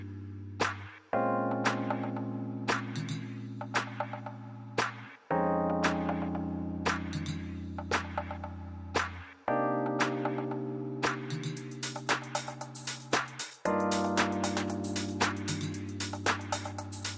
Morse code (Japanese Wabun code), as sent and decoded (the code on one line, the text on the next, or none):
none